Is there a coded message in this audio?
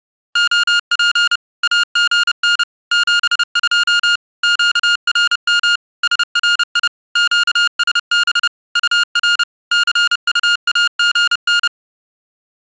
Yes: Morse code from 0.3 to 11.7 s, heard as electronic beeps, machine-sent, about 30 wpm, 1420 Hz. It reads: OP AGN 72 QRM SRI QSB UR CUAGN